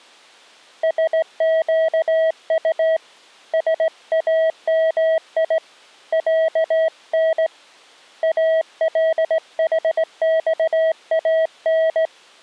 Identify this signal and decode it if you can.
Morse code (Arabic alphabet), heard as a keyed tone, hand-sent with a straight key, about 18 wpm, 640 Hz. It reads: سقط سامي عن الحصان